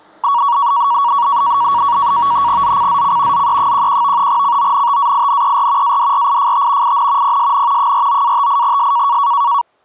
NAVTEX (SITOR-B), 100 baud, 170 Hz shift, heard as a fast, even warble, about 1040 Hz centre, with the noise of a residential street. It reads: ZCZC ZE11 CONTAINER ADRIFT IN PSN 49-58S